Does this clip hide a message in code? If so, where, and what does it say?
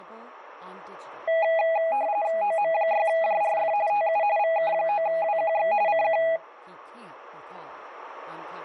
Yes: RTTY (45.45 baud, 170 Hz shift) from 1.3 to 6.4 s, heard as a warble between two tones, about 740 Hz centre, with speech in English. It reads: OM6JRF TU VK9WQX CQ